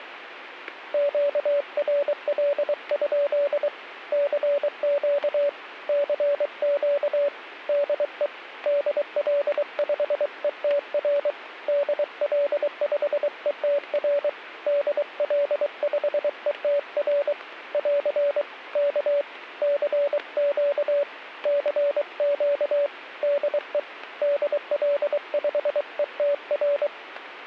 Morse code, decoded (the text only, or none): QRL? CQ CQ DE DL5ETR DL5ETR DL5ETR <AR> K CQ CQ DE DL5ETR